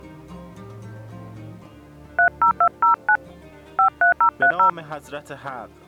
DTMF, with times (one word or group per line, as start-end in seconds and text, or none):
2.2-3.2 30209
3.8-4.7 53030